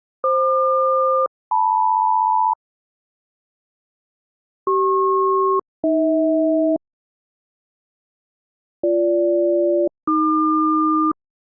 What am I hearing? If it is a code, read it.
Aircraft SELCAL, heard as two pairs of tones. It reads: FQ-LM CP-AH BG-AQ